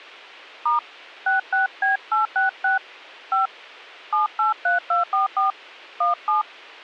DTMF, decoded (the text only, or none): * 66B866 5 783244 17